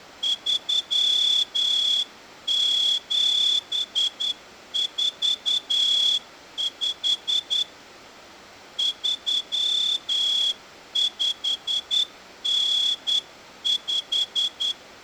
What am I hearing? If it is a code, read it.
Morse code (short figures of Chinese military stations), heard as a whistle, hand-sent with a straight key, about 10 wpm, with room echo. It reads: 3745 3595